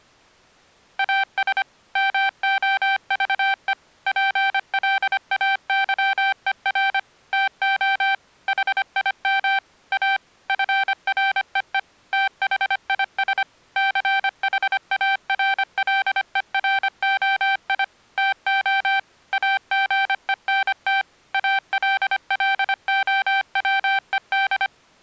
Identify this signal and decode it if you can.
Morse code, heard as electronic beeps, machine-sent, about 25 wpm, 780 Hz. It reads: AS MOVE PLAYER TO HIM A FREE THIS CHARLEROI TO AGENT ALLOWED